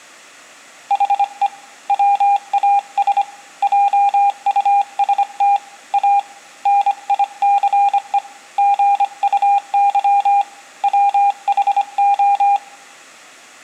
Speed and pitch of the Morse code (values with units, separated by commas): 25 wpm, 800 Hz